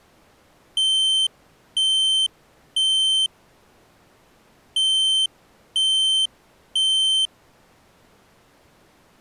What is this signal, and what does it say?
Alarm pattern, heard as an alarm's beeps, played twice, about 3100 Hz. Temporal three. Smoke or fire, evacuate.